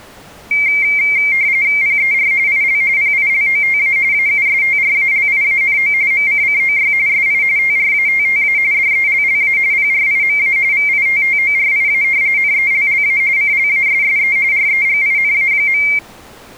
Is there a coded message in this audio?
Yes: RTTY (45.45 baud, 170 Hz shift) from 0.5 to 16.0 s, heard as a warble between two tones, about 2200 Hz centre. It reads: PER IL PILOTA AUSTRALIANO MCCOY SI TRATTA DELLA PRIMA VITTORIA NELLA CLASSE REGINA.